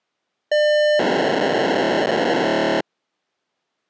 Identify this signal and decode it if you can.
POCSAG pager data (1200 baud), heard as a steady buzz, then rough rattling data.